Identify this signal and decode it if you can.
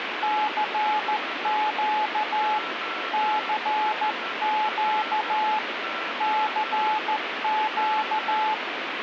Morse code, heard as a keyed tone, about 14 wpm, 860 Hz, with radio static and a weaker station near 1340 Hz. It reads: CQ CQ CQ